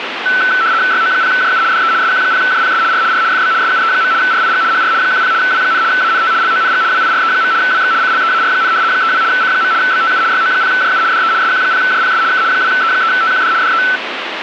RTTY (75 baud, 170 Hz shift), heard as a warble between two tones, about 1420 Hz centre, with radio static. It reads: YO0JU DE SQ0JPS R R FB SUE. RIG HR 10 W, ANT LONG WIRE. WX CLEAR, 32 C. BTU YO0JU DE SQ0JPS K 2E3TQD DE